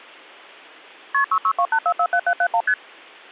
Multi-frequency trunk signalling (R1, as on North American trunks), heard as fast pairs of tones, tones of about 70 ms. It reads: KP 6628447771 ST